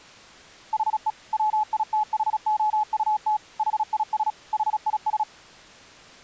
Morse code, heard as a keyed tone, machine-sent, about 36 wpm, 850 Hz. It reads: HE WITHOUT HIS HIS